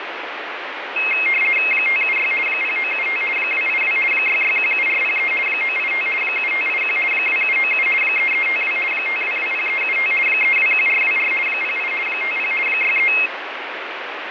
RTTY (50 baud, 450 Hz shift), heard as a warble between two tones, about 2350 Hz centre, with radio static. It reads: 576 0975 282 6617403 985 7581 2797 3352 5220375 321424 08 50 63